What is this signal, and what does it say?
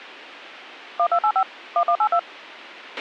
DTMF, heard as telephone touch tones, dialled by machine, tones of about 70 ms, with a squelch burst at the end. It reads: 1285 1182